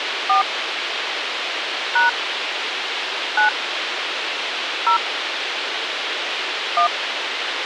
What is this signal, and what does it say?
DTMF, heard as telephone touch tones, dialled by hand, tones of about 110 ms, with radio hiss. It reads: 4 # 9 0 1